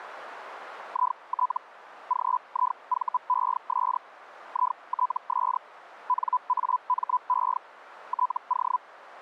Hellschreiber (Feld-Hell, 122.5 baud), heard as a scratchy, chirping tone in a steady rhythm, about 1000 Hz. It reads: IT GIVES ITS NAME TO